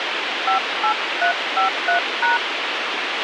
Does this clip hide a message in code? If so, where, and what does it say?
Yes: DTMF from 0.5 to 2.4 s, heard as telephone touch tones, dialled by hand, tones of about 110 ms, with radio hiss and a squelch burst at the end. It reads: 58353#